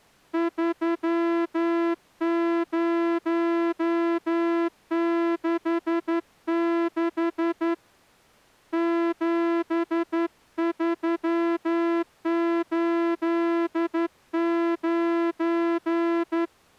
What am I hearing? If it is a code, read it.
Morse code, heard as a horn, hand-sent with a straight key, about 11 wpm. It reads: 3066 7389